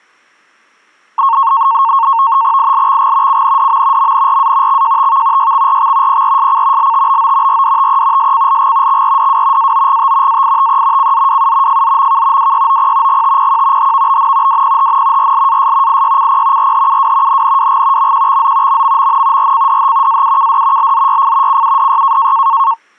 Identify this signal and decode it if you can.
NAVTEX (SITOR-B), 100 baud, 170 Hz shift, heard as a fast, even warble, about 1000 Hz centre. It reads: ILXG CNDM MNRA XJTV YXRX PRSC LTBO RDTE SCLG XRDW AOGT AITE CZWU FZMK WYOP GTPQ HVBN WPHN RLAS IYCP RHUW NNWG MQXZ MMMN RCDH AUKD LZYF CUDY